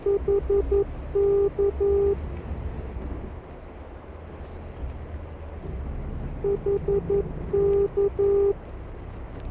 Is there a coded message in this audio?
Yes: Morse code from 0.0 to 8.6 s, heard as a keyed tone, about 11 wpm, 400 Hz, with radio static, a narrow filter and the noise inside a bus. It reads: HK HK